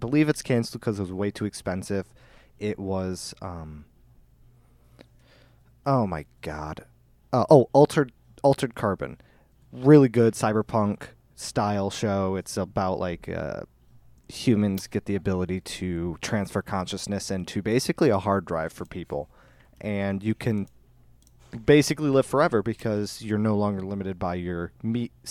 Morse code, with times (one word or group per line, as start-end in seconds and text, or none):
none